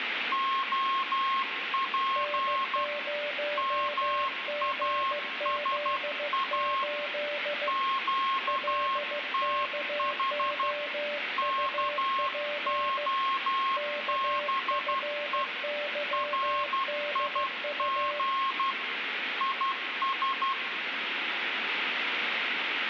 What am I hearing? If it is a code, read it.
Morse code, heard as two keyed tones, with radio static and room echo. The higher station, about 12 wpm, 1080 Hz: OP MASA QTH KOBE RIG IS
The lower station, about 15 wpm, 590 Hz: N0GZ8 LKOUP KFYDU